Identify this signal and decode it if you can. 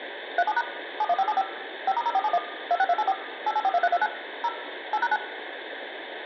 DTMF, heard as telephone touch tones, dialled by machine, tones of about 50 ms, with phone line noise and room echo. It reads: 37# 71575 5*0471 26284 8842329 0 8#9